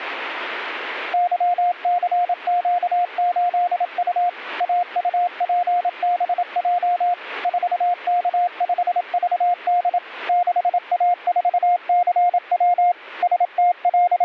Morse code, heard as a keyed tone, machine-sent, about 27 wpm, 710 Hz. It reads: YCQ8U AUPBJ 4K5VD 6A4CW …